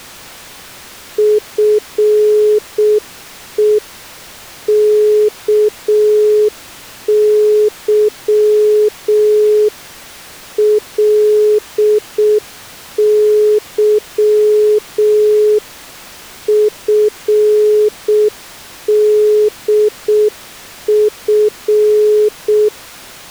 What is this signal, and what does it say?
Morse code (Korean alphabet), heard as a keyed tone, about 6 wpm, 420 Hz. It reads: 나에게는